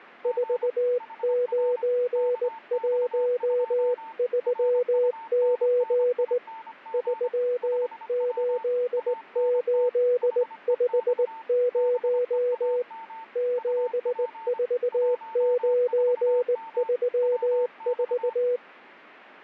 Morse code, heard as a keyed tone, hand-sent with a straight key, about 19 wpm, 490 Hz, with a weaker station near 900 Hz. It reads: 49138 38850 74934